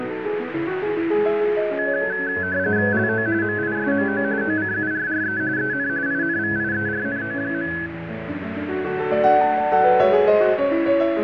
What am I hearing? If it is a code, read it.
RTTY (45.45 baud, 170 Hz shift), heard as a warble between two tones, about 1600 Hz centre, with radio static. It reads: LO MISMO OCURRE EN INVIERNO.